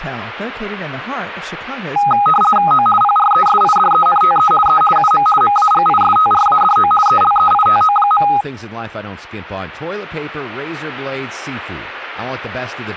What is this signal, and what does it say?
RTTY (50 baud, 450 Hz shift), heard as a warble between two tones, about 1040 Hz centre, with speech in English. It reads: O PRESIDENTE E UM MAGISTRADO ELEITO.